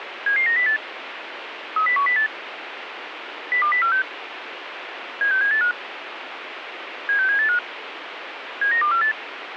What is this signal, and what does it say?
Five-tone selective call (CCIR), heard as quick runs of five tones, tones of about 100 ms, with radio hiss. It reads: 77908 30108 02046 76785 76785 79248